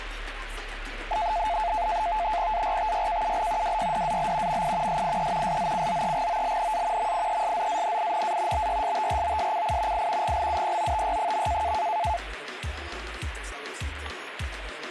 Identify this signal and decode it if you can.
NAVTEX (SITOR-B), 100 baud, 170 Hz shift, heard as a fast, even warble, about 780 Hz centre, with radio static. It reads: ARTYKUL WYDAL MI SIE SZCZEGOLNA MIESZANINA BYSTROSCI I GLUPOTY.